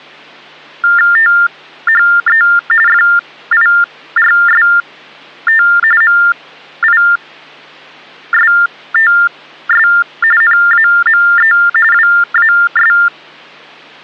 TTY/TDD text telephone tones (45.45 baud Baudot), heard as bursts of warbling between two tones, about 400 Hz shift, 1600 Hz centre. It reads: THE FIRST MISTS NAME WAS